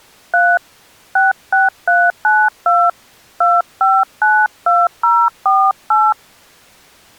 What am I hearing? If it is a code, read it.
DTMF, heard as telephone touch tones, dialled by hand, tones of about 220 ms. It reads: 3 66392 2592048